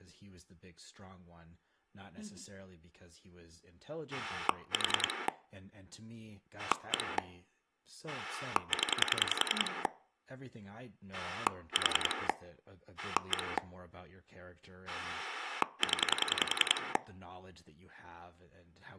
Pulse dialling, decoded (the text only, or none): 4 1 0 4 1 0